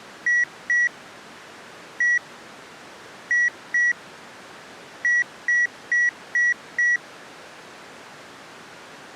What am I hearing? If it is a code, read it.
Beep code, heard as beeps, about 1950 Hz. 2-1-2-5.